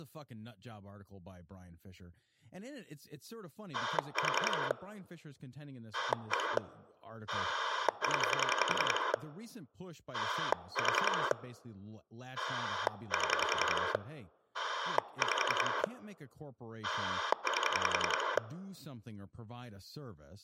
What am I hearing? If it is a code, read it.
Pulse dialling, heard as a rotary dial, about 10 pulses a second, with speech in English. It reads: 4 1 0 4 7 5 8